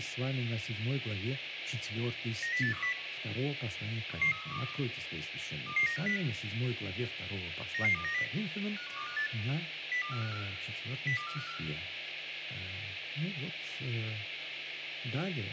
Five-tone selective call (CCIR), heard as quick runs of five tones, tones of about 100 ms, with radio hiss. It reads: 90810 11312 22950 99290 51258 02454 02454